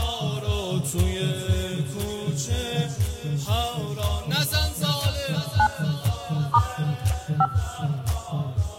DTMF, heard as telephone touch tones, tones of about 70 ms, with room echo. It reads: 9 * 5